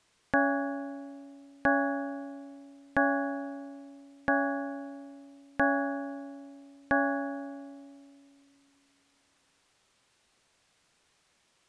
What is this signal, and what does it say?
Clock strike, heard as a bell. 6. Six o'clock.